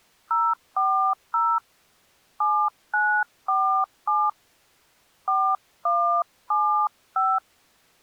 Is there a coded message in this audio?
Yes: DTMF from 0.3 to 7.4 s, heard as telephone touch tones, dialled by hand, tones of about 300 ms. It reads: 040 7947 4175